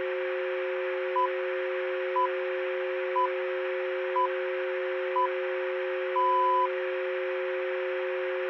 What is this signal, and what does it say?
Radio time signal (six pips, as the Greenwich Time Signal), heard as pips, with radio static.